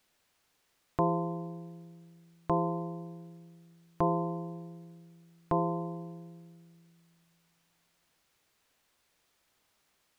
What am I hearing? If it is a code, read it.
Clock strike, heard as a bell. 4. Four o'clock.